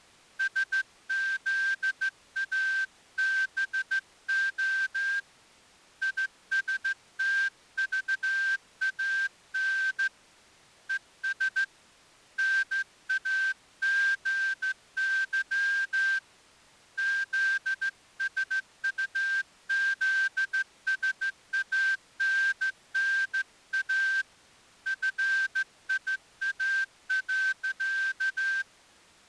Morse code, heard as a whistle, hand-sent with a straight key, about 14 wpm. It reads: SZABO ISTVAN ES NAGY ZSUZSANNA FIA.